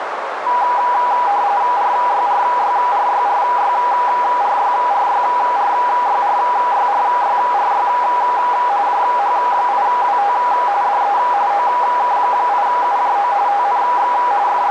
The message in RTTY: RYRYRYRYRYRYRYRYRYRY JH8WT DE OK8UJO TNX …

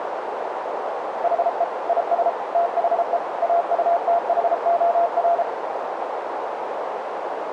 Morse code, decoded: HE IS THE AUTHOR

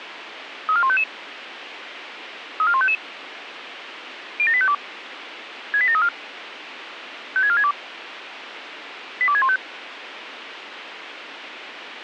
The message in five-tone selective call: 34155 34155 07852 68734 56462 82615

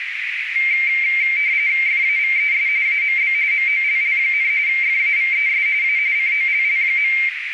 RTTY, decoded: FAVES AMB MOLL, FAVES A COLL.

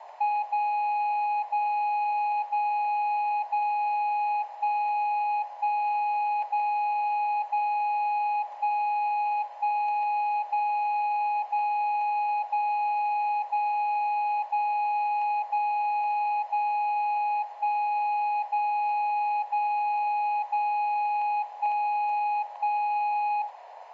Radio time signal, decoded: 0 0 0 0 1 1 0 0 1 1 0 0 0 0 0 0 0 1 0 0 0 1 1

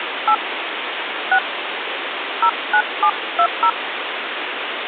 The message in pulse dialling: none

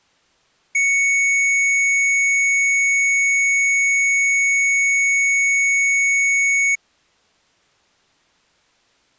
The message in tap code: none

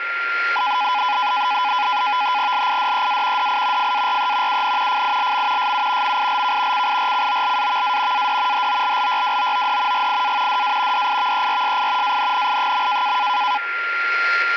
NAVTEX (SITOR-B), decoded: LIDEA DI FARE UN FILM SU MILK CIRCOLAVA AD HOLLYWOOD GIA DA DIVERSI ANNI.

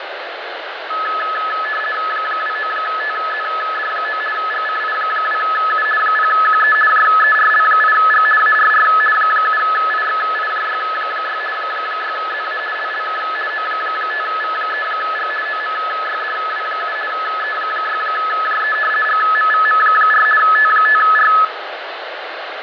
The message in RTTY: 29TZD9 GCI2U 0QE JERL8G ARR 7IXIJY6 6ZA LLK O5V3G OMYDW7 E6JE GMVM4 T5R

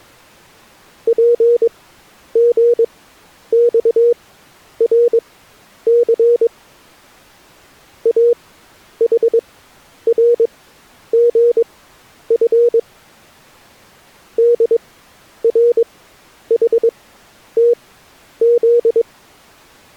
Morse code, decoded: PGXRC AHRGF DRHTZ

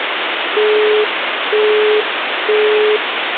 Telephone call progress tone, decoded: busy tone

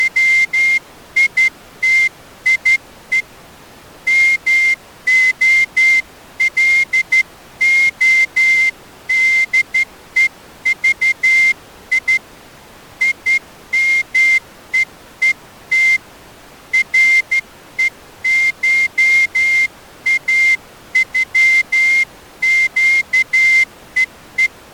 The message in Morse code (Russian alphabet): … МОЛОДЕЖИ ИМЕЕТ РЕШАЮЩЕЕ

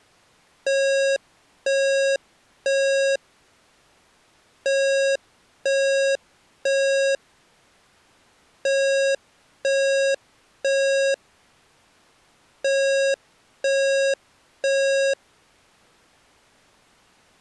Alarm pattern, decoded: temporal three

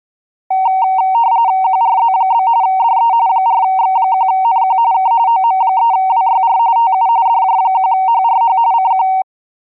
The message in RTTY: QRZ? DE 4X1NQ K OM3WYR TU DJ1HRH CQ

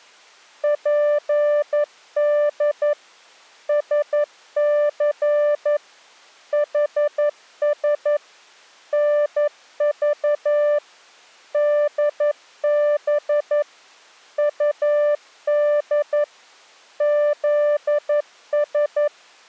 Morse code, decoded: PD SC HS NV DB UD ZS

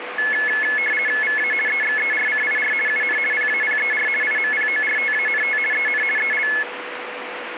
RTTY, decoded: VA EXERCIR UN PAPER IMPORTANT EN EL

